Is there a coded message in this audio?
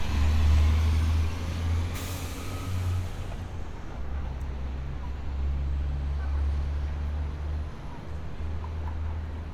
No, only street noise.